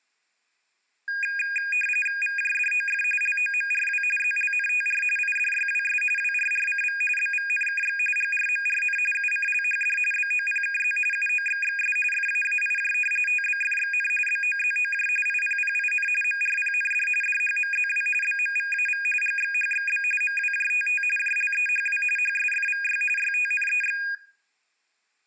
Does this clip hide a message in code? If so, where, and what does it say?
Yes: RTTY (45.45 baud, 850 Hz shift) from 1.1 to 24.1 s, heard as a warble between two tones, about 2050 Hz centre, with room echo. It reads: VJDOF LOMRW ZLNTR IDYWS WRRCV BVNKX GRMRN UCLHD BOPKZ UOXXS FAAIJ TBFXN BOZOJ IPPIN MRPND DHMZW BMVAV GXHXB MWJTT JLEHW HSFVY YTNEX